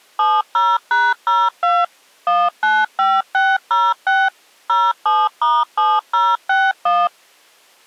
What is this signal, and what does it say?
DTMF, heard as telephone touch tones, dialled by machine, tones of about 220 ms. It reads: 70#02 195606 07*7061